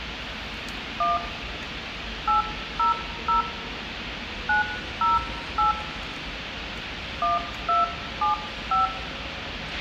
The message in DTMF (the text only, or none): 1 800 908 1275